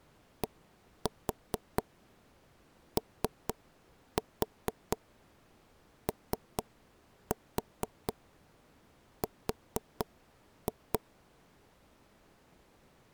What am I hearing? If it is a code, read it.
Tap code, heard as knocks on wood, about 4 knocks a second. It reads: DOOR